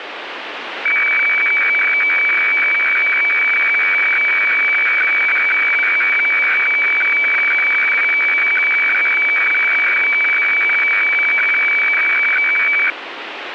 Weather fax (radiofax), 120 lines a minute, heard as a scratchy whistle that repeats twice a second, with radio static.